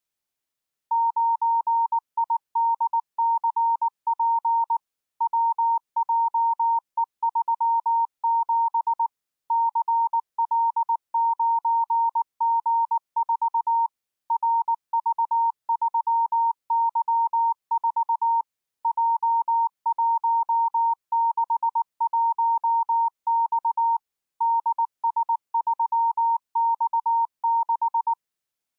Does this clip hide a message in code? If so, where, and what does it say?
Yes: Morse code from 0.9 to 28.2 s, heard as a keyed tone, machine-sent, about 19 wpm, 920 Hz. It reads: 9IDCP WJE37 CL9G4 RV3Y4 J161X DS3X6